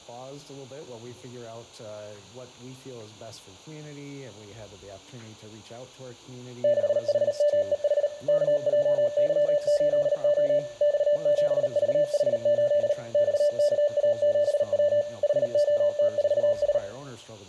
Morse code, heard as a keyed tone, machine-sent, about 38 wpm, 590 Hz, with room echo. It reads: 6HMEH KJY8O X7VH8 XKA7W HOT4S